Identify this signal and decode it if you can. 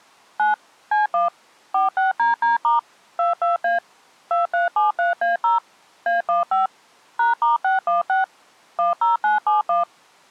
DTMF, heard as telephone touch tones, dialled by machine, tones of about 150 ms. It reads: 9 C1 46DD* 22A 2373A0 A15 #*616 10971